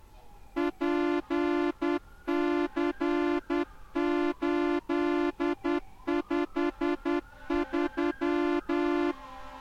Morse code, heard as a horn, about 10 wpm, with street noise. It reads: PC853